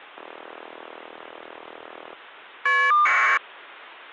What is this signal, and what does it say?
Caller ID data burst, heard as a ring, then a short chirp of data, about 1200 baud.